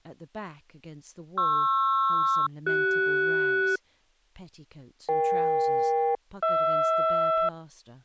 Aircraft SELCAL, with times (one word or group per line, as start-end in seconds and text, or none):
1.4-3.8 PR-CS
5.1-7.5 EK-HR